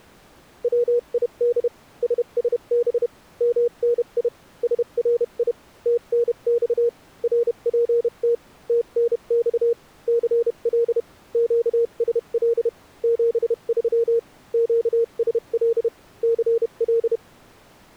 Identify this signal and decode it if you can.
Morse code, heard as a keyed tone, machine-sent, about 31 wpm, spaced as for 28 wpm, 470 Hz. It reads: WID SSB MNI SRI TNX RPT TNX CL QSL 73 QSL CL